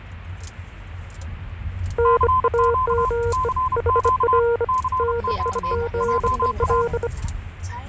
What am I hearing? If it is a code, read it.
Morse code, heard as two keyed tones, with the noise inside a car. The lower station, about 25 wpm, 470 Hz: NAME HR NIGEL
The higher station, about 31 wpm, 1030 Hz: CQ CQ CQ JA